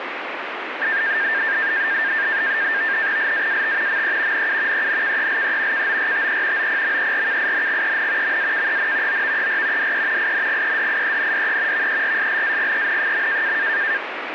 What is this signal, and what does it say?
NAVTEX (SITOR-B), 100 baud, 170 Hz shift, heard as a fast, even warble, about 1700 Hz centre, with radio static. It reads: LAAT ME NU ENKELE KORTE OPMERKINGEN MAKEN OVER DE INGEDIENDE VERSLAGEN.